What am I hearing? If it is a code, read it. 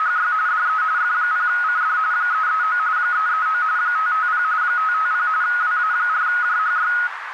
RTTY (45.45 baud, 170 Hz shift), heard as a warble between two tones, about 1360 Hz centre, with radio static and a narrow filter. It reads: … DE F0CD 339 339 550 550 WA4JHY